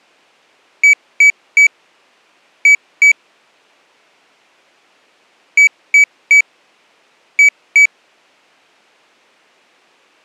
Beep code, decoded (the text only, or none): 3-2